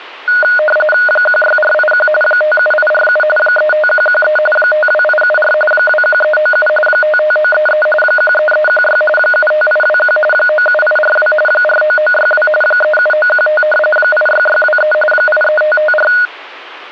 RTTY (45.45 baud, 850 Hz shift), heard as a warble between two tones, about 1040 Hz centre. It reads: 16481 57847 35113 52874 21397 55933 13316 75821 97842 49962 37915 86623 83554